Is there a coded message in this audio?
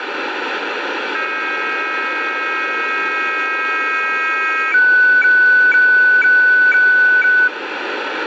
Yes: weather fax (radiofax), 120 lines a minute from 1.1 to 7.5 s, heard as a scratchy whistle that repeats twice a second, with heavy radio static.